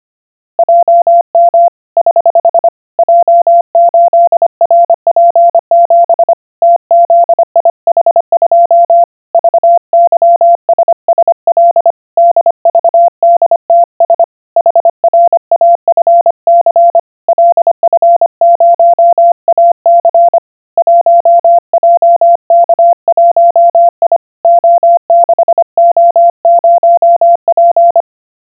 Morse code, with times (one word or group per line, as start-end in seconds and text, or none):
0.6-1.7 JM
2.0-2.7 <HH>
3.0-6.3 J8RP7
6.6-9.0 TZIH2
9.3-11.9 VYSSL
12.2-14.2 DVDTS
14.6-17.0 HRAFC
17.3-20.4 LF0AC
20.8-24.2 1JK1I
24.4-28.0 O6O0P